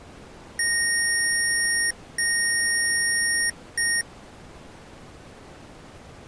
Beep code, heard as beeps from a small speaker, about 1850 Hz. 2 long, 1 short.